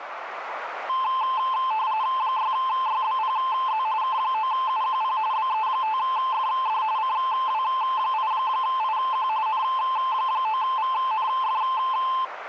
RTTY (45.45 baud, 170 Hz shift), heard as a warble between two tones, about 960 Hz centre, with radio static and a narrow filter. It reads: 6YBPZ K9UQP BE5FD CW8IQ N9VNF